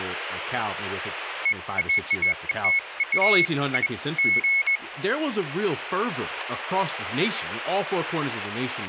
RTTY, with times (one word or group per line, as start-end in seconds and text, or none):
none